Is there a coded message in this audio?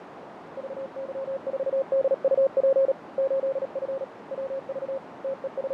Yes: Morse code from 0.5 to 5.7 s, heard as a keyed tone, hand-sent with a paddle, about 37 wpm, 540 Hz, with radio static, fading and a narrow filter. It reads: VY4DUP 8F WV …